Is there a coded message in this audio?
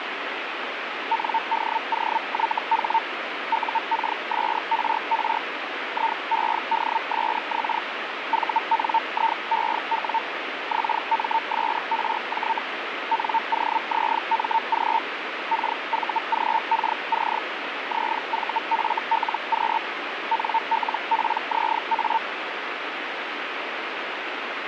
Yes: Hellschreiber (Feld-Hell, 122.5 baud) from 1.1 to 22.2 s, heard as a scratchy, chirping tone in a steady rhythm, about 900 Hz, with radio static. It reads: NDOYH UKSRR IEDSX VNIEW XMSRJ NOZMG KVGKC ZVFLQ NLPZA